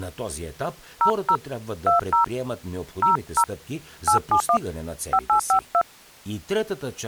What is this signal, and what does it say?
DTMF, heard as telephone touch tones, dialled by hand, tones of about 100 ms, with speech in Bulgarian. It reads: 00 20 00 871 5852